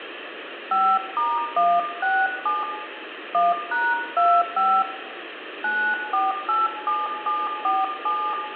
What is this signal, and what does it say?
DTMF, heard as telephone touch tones, dialled by hand, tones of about 240 ms, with phone line noise and room echo. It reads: 5*167 1#25 9487747